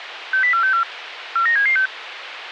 Five-tone selective call (CCIR), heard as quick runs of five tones, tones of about 100 ms, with radio hiss. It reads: 60464 49776